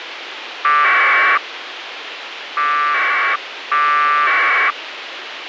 Packet radio (AX.25, as in APRS), 1200 baud, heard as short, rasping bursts, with radio hiss.